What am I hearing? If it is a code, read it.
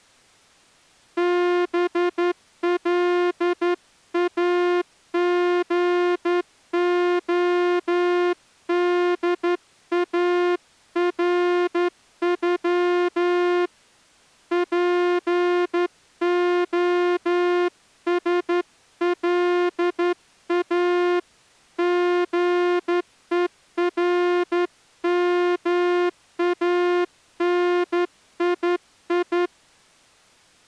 Morse code (Russian alphabet), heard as a horn, hand-sent with a straight key, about 11 wpm. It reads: БЛАГОДАРЮ ПОСЛА ГЕРМАНИИ